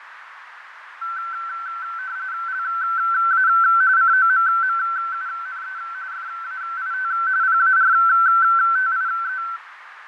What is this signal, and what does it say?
RTTY (45.45 baud, 170 Hz shift), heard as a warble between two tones, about 1440 Hz centre, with radio static, fading and a narrow filter. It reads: LA COMMUNE FAIT PARTIE